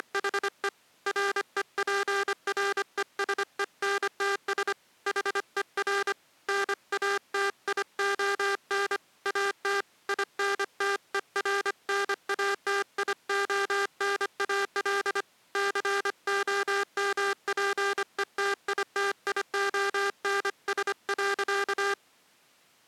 Morse code, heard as a buzzer, hand-sent with a paddle, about 25 wpm. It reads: … REPRESENTS HER NATION AT INTERNATIONAL COMPETITIONS.